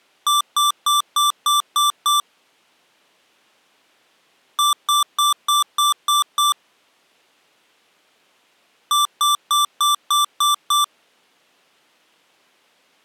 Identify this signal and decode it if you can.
Beep code, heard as beeps from a small speaker, played three times, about 1170 Hz. 7 short. In AMI BIOS tables: virtual mode exception error; in Dell tables: processor failure.